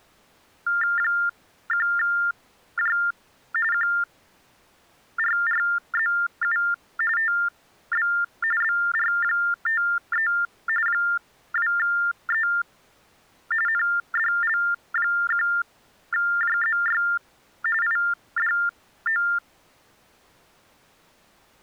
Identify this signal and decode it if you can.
TTY/TDD text telephone tones (45.45 baud Baudot), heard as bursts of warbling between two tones, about 400 Hz shift, 1600 Hz centre. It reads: 1J QRRZU TB BR53 2E NDL1JZY IDO